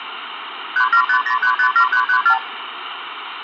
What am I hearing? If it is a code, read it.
Multi-frequency trunk signalling (R2, with the far end's replies), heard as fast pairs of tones, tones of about 80 ms, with phone line noise and room echo. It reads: 3750357334